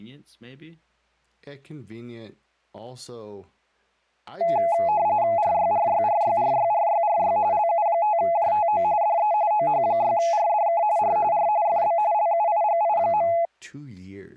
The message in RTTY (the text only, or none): RYRYRYRYRYRY LU5JTO DE OH6RDK R R FB LUIGI.